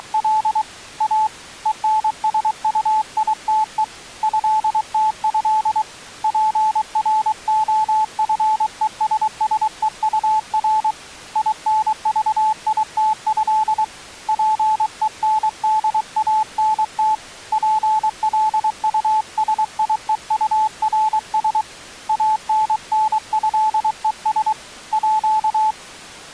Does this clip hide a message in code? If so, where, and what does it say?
Yes: Morse code (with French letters) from 0.0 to 25.8 s, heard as a keyed tone, hand-sent with a paddle, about 23 wpm, 870 Hz. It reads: … A ENSUITE ÉTÉ PROFESSEUR INVITÉ PENDANT PLUSIEURS ANNÉES À